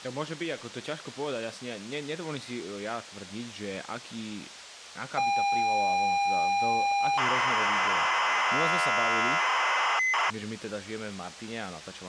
ZX Spectrum tape loading, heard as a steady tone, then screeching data, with speech in Slovak.